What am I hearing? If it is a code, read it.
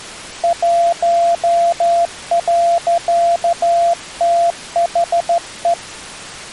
Morse code, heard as a keyed tone, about 13 wpm, 680 Hz. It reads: 1.THE